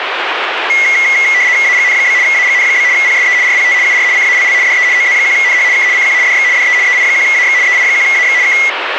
RTTY (75 baud, 170 Hz shift), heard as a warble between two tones, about 2050 Hz centre, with radio static. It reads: AGN? AGN? PSE RPT UR CALL DE OZ1NH K CQ DX DE EI1AX EI1AX K